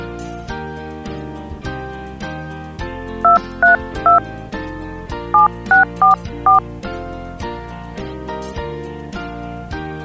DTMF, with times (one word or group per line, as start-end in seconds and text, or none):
3.2-4.2 232
5.3-6.6 7644